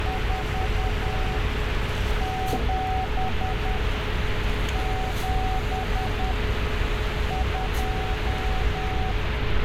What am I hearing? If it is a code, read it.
Morse code, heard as a keyed tone, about 10 wpm, 750 Hz, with heavy radio static and street noise. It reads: 4 7 7 2